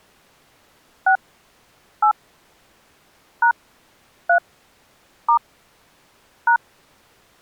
DTMF, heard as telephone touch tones, dialled by hand, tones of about 90 ms. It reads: 6 8 # 3 * #